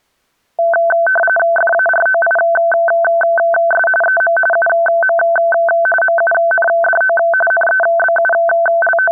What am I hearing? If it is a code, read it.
RTTY (45.45 baud, 850 Hz shift), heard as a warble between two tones, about 1100 Hz centre. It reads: FAROIS EM UM MUNDO …